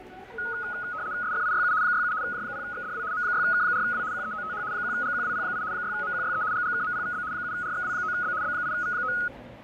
RTTY (75 baud, 170 Hz shift), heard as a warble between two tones, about 1360 Hz centre, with fading, static crashes and the noise of a subway station. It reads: SFIYU 67 J0XDW M6K4W QEOTH 1GQWP8 6MQYE GGKMPVB 7RXW9B B8V9